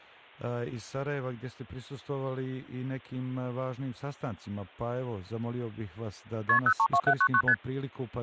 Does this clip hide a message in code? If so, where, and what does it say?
Yes: multi-frequency trunk signalling (R1, as on North American trunks) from 6.5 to 7.5 s, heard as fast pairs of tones, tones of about 70 ms. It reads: KP 032799 ST